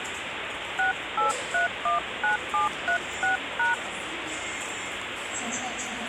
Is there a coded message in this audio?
Yes: DTMF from 0.8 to 3.7 s, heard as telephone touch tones, dialled by hand, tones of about 120 ms, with phone line noise and the noise of a subway station. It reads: 68319736#